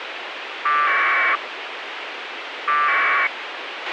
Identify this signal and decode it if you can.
Packet radio (AX.25, as in APRS), 1200 baud, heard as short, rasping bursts, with radio hiss and a squelch burst at the end.